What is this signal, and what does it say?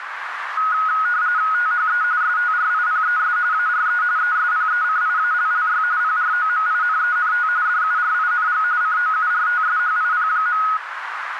RTTY (45.45 baud, 170 Hz shift), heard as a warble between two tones, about 1360 Hz centre, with radio static and a narrow filter. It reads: THE STRIPES ARE ESPECIALLY PROMINENT DURING COURTSHIP.